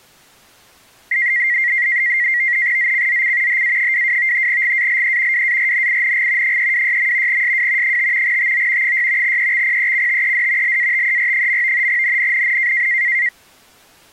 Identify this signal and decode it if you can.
NAVTEX (SITOR-B), 100 baud, 170 Hz shift, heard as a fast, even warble, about 2000 Hz centre. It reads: ZCZC HA22 GALE WARNING 326. SW 5 TO 6 EXPECTED LATER. NNNN